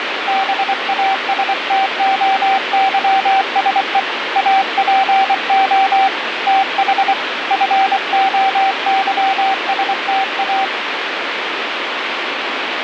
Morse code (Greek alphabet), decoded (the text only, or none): ΒΑΣΤΟΥΣΕ ΑΠΟ ΤΗ ΦΟΥΣΤΑ